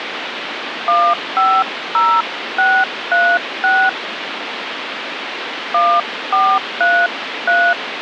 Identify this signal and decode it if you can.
DTMF, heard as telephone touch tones, dialled by hand, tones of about 260 ms, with phone line noise. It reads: 150636 1433